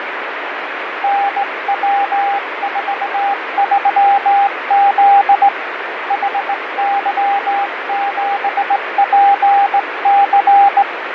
Morse code, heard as a keyed tone, hand-sent with a straight key, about 18 wpm, 800 Hz, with radio static and fading. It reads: NW43Z HY7PC